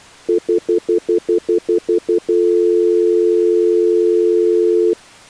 Telephone call progress tone (North American plan), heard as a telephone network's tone, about 350, 440 Hz, 0.1 s on and 0.1 s off. Stutter dial tone.